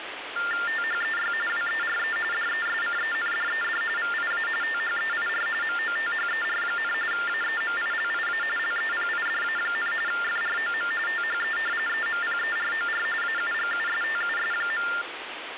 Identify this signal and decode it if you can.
TTY/TDD text telephone tones (45.45 baud Baudot), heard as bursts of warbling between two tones, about 400 Hz shift, 1600 Hz centre, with phone line noise. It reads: THEY WERE DESCENDED VIA THEIR MOTHER, AEMILIA LEPIDA, FROM THE EMPEROR AUGUSTUS.